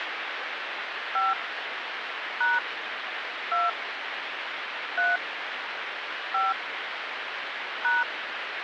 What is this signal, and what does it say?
DTMF, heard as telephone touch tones, dialled by hand, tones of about 180 ms, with phone line noise. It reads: 5 # 2 3 5 #